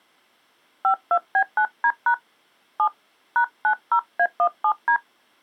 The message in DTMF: 52B9D# 7 #90A17D

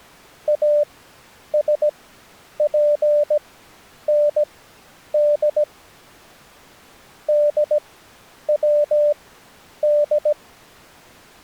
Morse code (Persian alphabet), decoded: اسپند دود

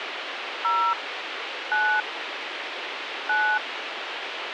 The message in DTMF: 0 9 9

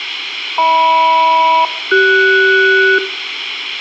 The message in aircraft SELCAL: HM-CS

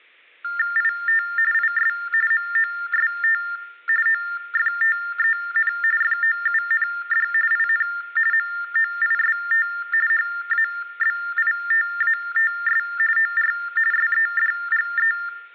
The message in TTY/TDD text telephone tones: IT IS MOST OFTEN FOUND IN MOIST HABITATS OR SEDGE

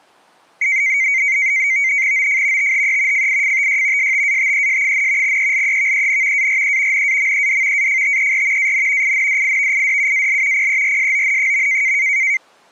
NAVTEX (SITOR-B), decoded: OF THE FIFTY STATES, ELEVEN ARE NAMED AFTER AN INDIVIDUAL PERSON.

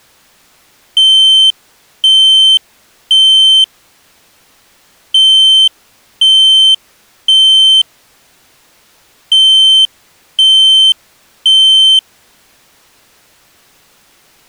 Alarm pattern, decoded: temporal three

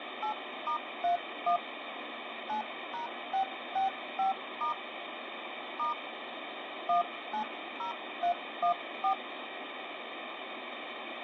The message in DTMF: 8*31 9#665* * 190314

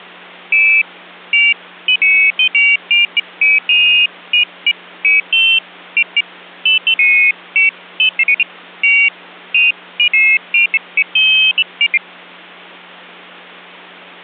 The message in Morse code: none

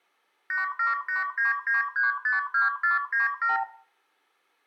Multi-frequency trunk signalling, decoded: 87899352497

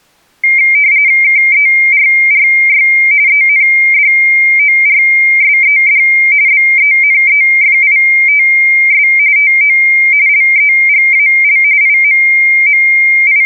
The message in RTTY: KERRY ENDORSED BENEFITS TO LEGAL …

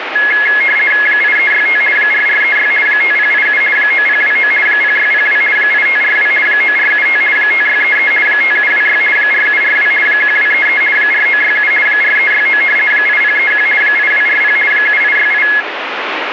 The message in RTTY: 8365 4436 5087 9029 0602 8542 9475 5633 5726 4742 1233 4967 4369 8031 8240 7868

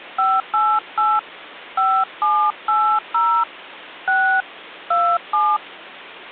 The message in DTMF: 588 5780 6 27

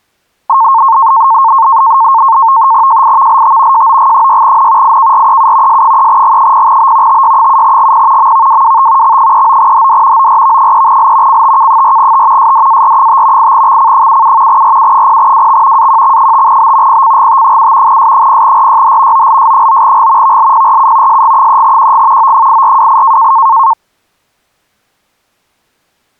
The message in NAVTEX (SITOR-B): JIVLT JOG6N IKREU S3G0B TY7GP MVWWT X39HD ORV3L CTK4T SDAR5 8XC77 RU0WX AQX5B PCGT7 S0RYH OLS9G VLPRU SG3QG O8428

